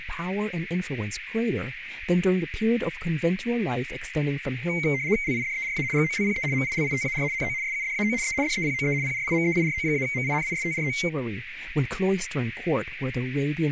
RTTY (75 baud, 170 Hz shift), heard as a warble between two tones, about 2150 Hz centre, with radio static, a narrow filter and speech in English. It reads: LIDERA GOLPE MILITAR NO SUDAO E DEPOE PRIMEIRO-MINISTRO